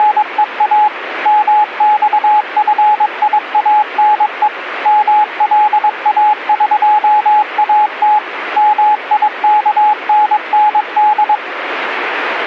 Morse code (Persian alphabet), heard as a keyed tone, machine-sent, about 22 wpm, 840 Hz, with radio static. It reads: … مخفیانه ملاقات میکنند